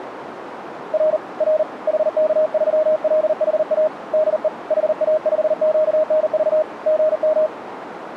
Morse code, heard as a keyed tone, hand-sent with a paddle, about 39 wpm, 620 Hz, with radio static and a narrow filter. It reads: R R HK3LHA DE HA5QNV GM